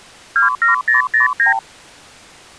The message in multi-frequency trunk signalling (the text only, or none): 27009